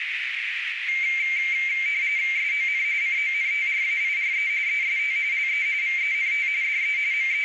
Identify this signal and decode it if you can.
RTTY (45.45 baud, 170 Hz shift), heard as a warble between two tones, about 2200 Hz centre, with radio static and a narrow filter. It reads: SON CONTRAIRE EST LE VENT DE …